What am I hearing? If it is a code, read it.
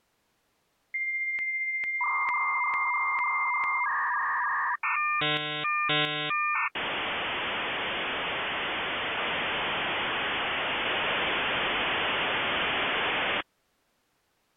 Dial-up modem handshake (V.34 or later), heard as a whistle, warbles, then hiss.